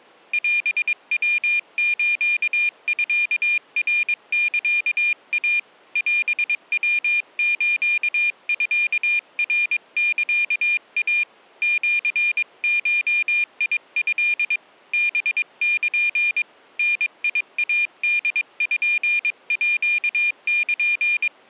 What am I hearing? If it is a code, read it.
Morse code (Japanese Wabun code), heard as a high beeper, hand-sent with a paddle, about 22 wpm, 2400 Hz. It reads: オヤスミナサイ オヤスミナサイ シゴト ハル ダイポール